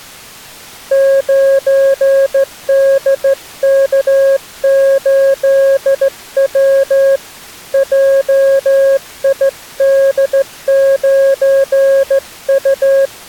Morse code, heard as a keyed tone, hand-sent with a straight key, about 15 wpm, 540 Hz. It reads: 9DK8W JID9U